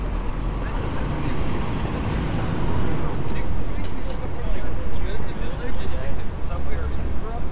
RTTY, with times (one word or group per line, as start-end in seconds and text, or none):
none